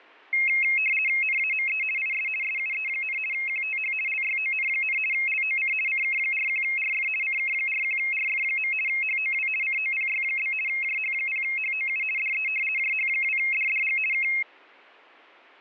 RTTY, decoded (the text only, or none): NAME IS SUE, QTH LYON, LOC CK41RF CK41RF. HOW COPY? JH0HOU DE JH2DDG K